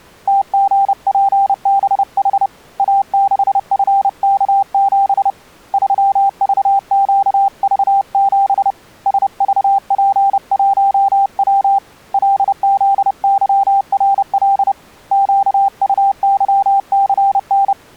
Morse code, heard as a keyed tone, hand-sent with a paddle, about 30 wpm, 790 Hz. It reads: TGPBH A6FK7 3VQV7 SVP1W LZYRL QUYCN